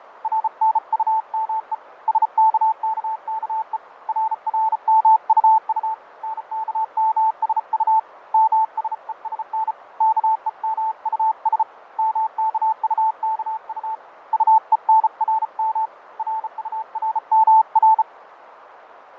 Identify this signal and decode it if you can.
Morse code, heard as a keyed tone, hand-sent with a bug key, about 34 wpm, 880 Hz, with radio static, fading and a narrow filter. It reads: RNUME SKKKE RRMUU NKMSU MSESN KEMUS MKUKU UENRM RURMR